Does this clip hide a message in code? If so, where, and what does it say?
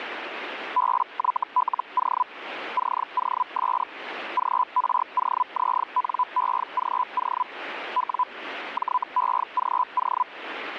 Yes: Hellschreiber (Feld-Hell, 122.5 baud) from 0.8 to 10.2 s, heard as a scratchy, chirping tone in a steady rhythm, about 1000 Hz, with radio static. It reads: BYLO COS GROZNEGO W JEGO